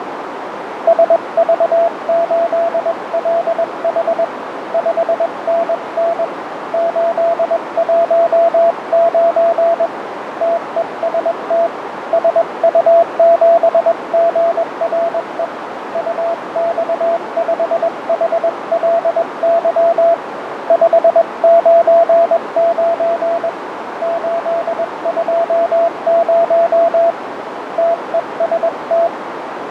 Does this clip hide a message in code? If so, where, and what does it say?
Yes: Morse code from 0.8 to 29.1 s, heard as a keyed tone, hand-sent with a paddle, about 21 wpm, 680 Hz, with radio static, fading and a narrow filter. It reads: SV8LH 5NN 819 TEST SU7GRE UX5HLY 599 820 TEST